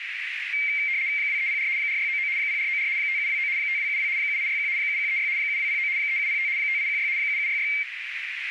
RTTY (75 baud, 170 Hz shift), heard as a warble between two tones, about 2200 Hz centre, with radio static and a narrow filter. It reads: 2304 4699 0494 5729 5272 7861 7136 7209 3705 5816 7766